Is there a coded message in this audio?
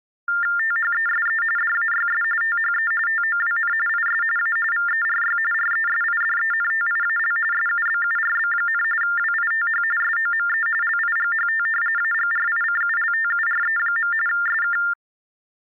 Yes: TTY/TDD text telephone tones (45.45 baud Baudot) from 0.3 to 14.9 s, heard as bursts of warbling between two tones, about 400 Hz shift, 1600 Hz centre. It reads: THESE DAYS THE TOWN IS A VERY RESIDENTIAL SUBURB, WITH SOME LIGHT AGRICULTURE. SK